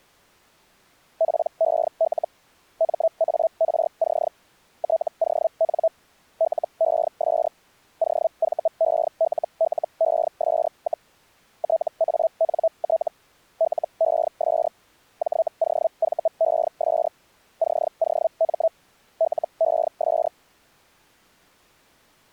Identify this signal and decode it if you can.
Hellschreiber (Feld-Hell, 122.5 baud), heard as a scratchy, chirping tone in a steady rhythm, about 650 Hz. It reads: PEL MARC TON LES OVELLES, TANT LES JOVES COM LES